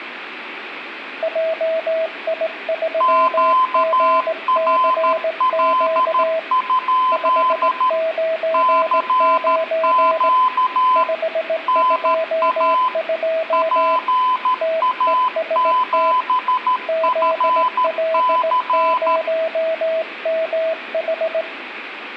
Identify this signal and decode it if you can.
Morse code, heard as two keyed tones, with room echo. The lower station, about 18 wpm, 650 Hz: JI3GCQ 599 522 TEST ZL0MH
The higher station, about 13 wpm, 1020 Hz: QRL? CQ NA PA7FC